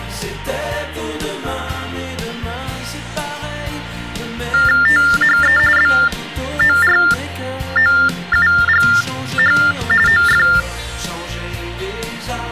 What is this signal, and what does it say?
TTY/TDD text telephone tones (45.45 baud Baudot), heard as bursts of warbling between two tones, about 400 Hz shift, 1600 Hz centre. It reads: THE BOROUGH OF